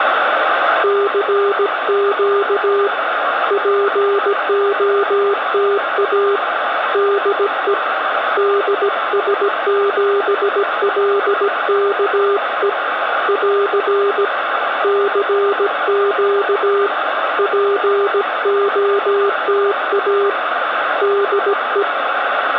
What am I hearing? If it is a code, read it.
Morse code, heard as a keyed tone, hand-sent with a paddle, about 17 wpm, 400 Hz, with radio static and room echo. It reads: CQ POTA DE DS7LKE <AR> CQ POTA DE